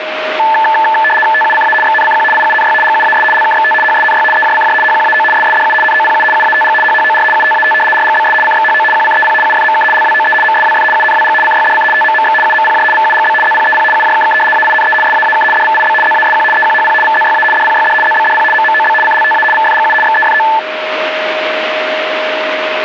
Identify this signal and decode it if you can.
RTTY (75 baud, 850 Hz shift), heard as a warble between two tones, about 1310 Hz centre, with radio static and a steady whistle near 620 Hz. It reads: TUCA XNCQ IUNY GUAS LKXT HSNY EJCJ HQAO SSDU NOPU UATG HHOR UTAT RGBS CXHO QCEP UFMK LWOE MSWF UNWG CYDC TMMX UMPJ VUGB ZPEP UJKK AINE SAAK DVIB ZASQ EQHP VZYA DPYD ZBDP MMOB CLTA VFGU XEFO